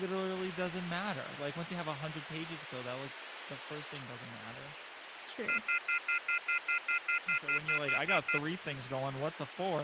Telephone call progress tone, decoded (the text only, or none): off-hook warning tone